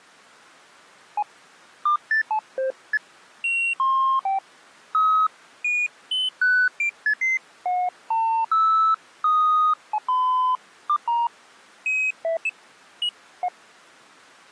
Electronic bleeps of random pitch and length. There is no code.